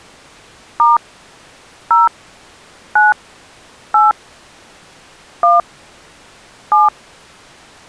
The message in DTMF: * 0 9 8 1 7

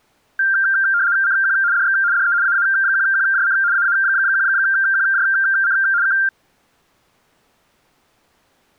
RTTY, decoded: CQ DX DE AA1QJC AA1QJC K

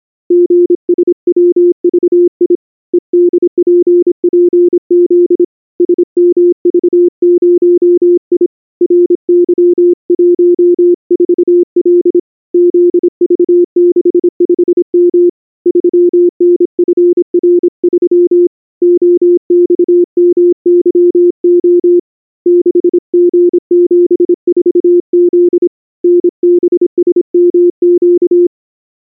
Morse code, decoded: GSWVI EDPPZ SMV0I RY14L ZV65M 3NFR3 OXMYO 6G74Z NBSMQ

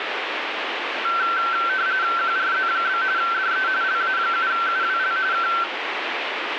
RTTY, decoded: QRZ? DE LA7UWL K

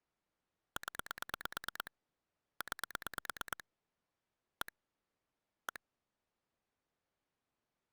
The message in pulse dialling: 0 9 1 1

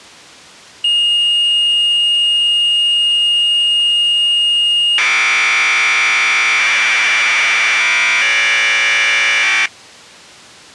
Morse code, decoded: none

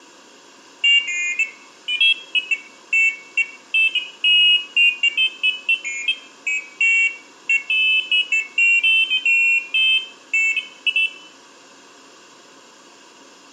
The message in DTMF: none

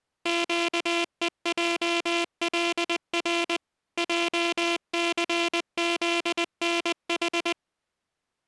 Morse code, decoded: QEJLR JCZNH

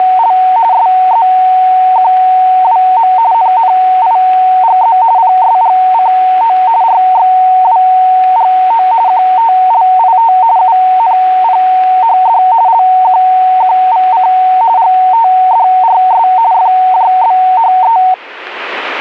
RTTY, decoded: … SZQWM NNIGZ PSGCO RXWGO QTLIT UNPHD LQQVC GTDRS FJBHE

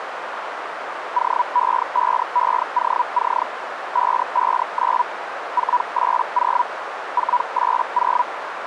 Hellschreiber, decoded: OE5EOC 559 480 480

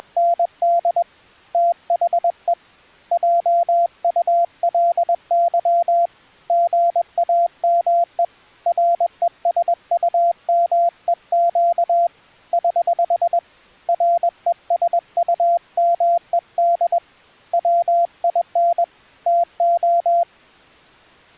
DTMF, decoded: none

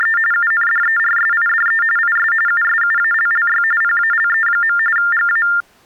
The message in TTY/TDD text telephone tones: … UNDERSIDE IS USUALLY PALE. GA

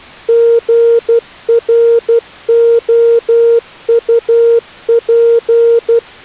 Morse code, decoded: GROUP

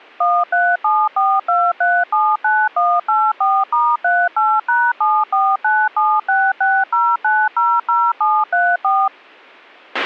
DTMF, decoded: 13742379184*38#7497660900734

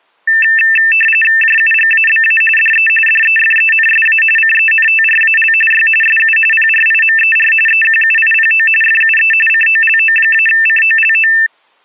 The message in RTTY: JUGABA DE DEFENSA CENTRAL Y SU PRIMER EQUIPO FUE COLO-COLO

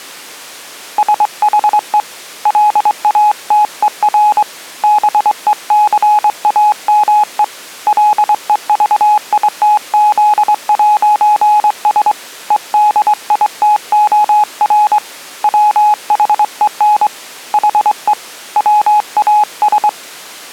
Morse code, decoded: SHE LATER BECAME LEVITZ'S EDITOR WHEN HE WAS

